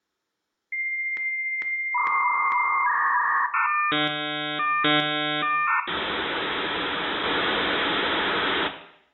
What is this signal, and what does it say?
Dial-up modem handshake (V.34 or later), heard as a whistle, warbles, then hiss, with room echo.